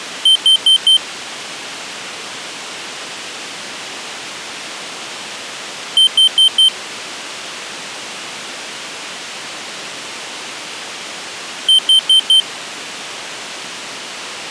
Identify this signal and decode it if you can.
Alarm pattern, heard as an alarm's beeps, played three times, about 3100 Hz. Temporal four. Carbon monoxide.